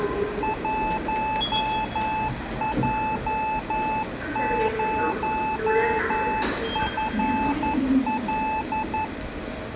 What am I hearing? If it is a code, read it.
Morse code, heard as a keyed tone, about 11 wpm, 870 Hz, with room echo and the noise of a subway station. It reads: 1J0FL